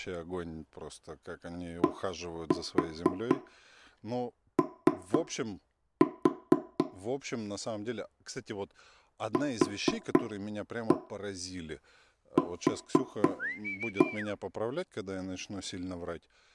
Tap code, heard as knocks on wood, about 4 knocks a second, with room echo and speech in Russian. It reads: DO QQ